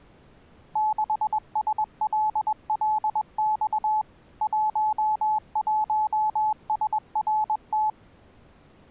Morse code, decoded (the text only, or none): 6SLLX 11SRT